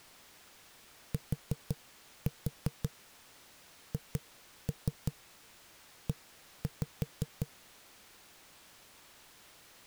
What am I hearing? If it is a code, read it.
Tap code, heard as knocks on a wall, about 5 knocks a second. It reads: THE